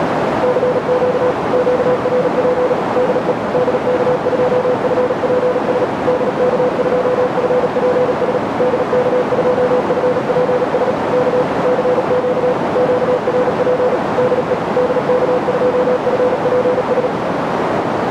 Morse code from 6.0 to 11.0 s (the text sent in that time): DK2FPS DK2FPS